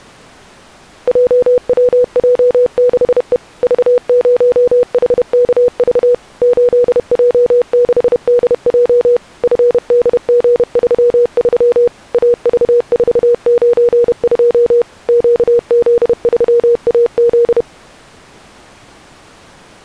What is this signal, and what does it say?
Morse code, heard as a keyed tone, machine-sent, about 31 wpm, 480 Hz. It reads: JWJ6E V0HKV 8J6DJ FDG33 AV492 QZ3AZ